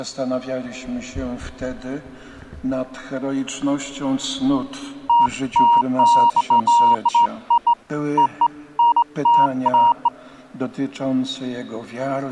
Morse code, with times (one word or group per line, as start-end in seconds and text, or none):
none